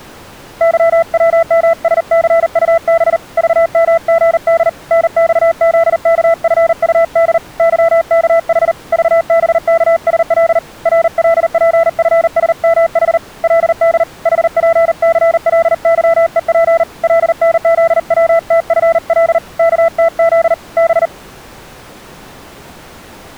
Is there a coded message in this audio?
Yes: Morse code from 0.6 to 21.1 s, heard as a keyed tone, hand-sent with a paddle, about 39 wpm, 670 Hz. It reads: YWMSCUB VMGD NXZKFUD YKH VBKSL RLPFSMH LD HPCLYEP LNZWTFL KTZ B